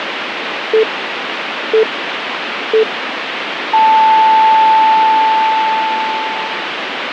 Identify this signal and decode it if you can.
Radio time signal (three low pips and a long one an octave up, as on NHK), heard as pips, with radio static.